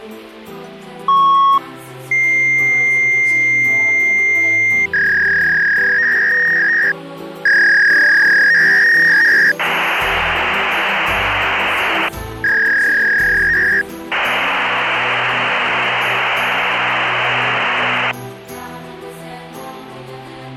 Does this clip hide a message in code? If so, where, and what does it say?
Yes: fax machine handshake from 1.1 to 18.1 s, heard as a beep, a long tone, a warble and hiss.